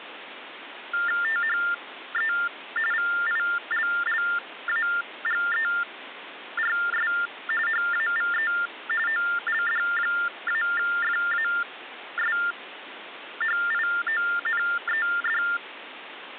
TTY/TDD text telephone tones (45.45 baud Baudot), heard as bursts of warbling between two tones, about 400 Hz shift, 1600 Hz centre, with phone line noise. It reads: THE VILLAGERS HAVE OLD-FASHIONED